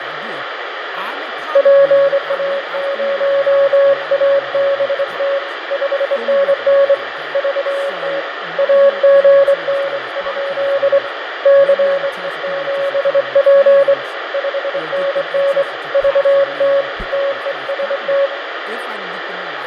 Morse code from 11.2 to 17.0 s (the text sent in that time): CE7P 5NN VT